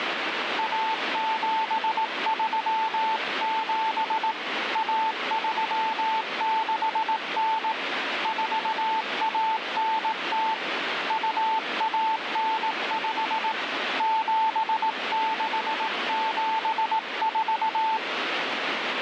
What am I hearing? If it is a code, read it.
Morse code (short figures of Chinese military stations), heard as a keyed tone, hand-sent with a paddle, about 18 wpm, 880 Hz, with radio static. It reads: 1737 1369 4190 2195 7674